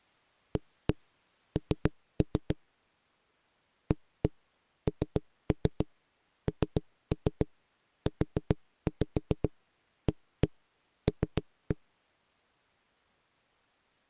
Tap code, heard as knocks on a wall, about 7 knocks a second. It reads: AN ANNUAL